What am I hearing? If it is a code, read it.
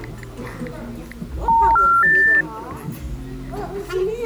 Telephone call progress tone (North American plan), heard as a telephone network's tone, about 910, 1370, 1800 Hz, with the noise of a restaurant. Special information tone.